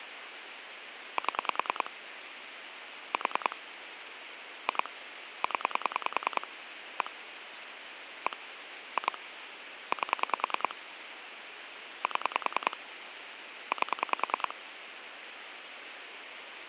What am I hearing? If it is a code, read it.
Pulse dialling, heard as clicks on a phone line, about 10 pulses a second, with phone line noise. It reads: 7 4 2 0 1 1 2 8 7 8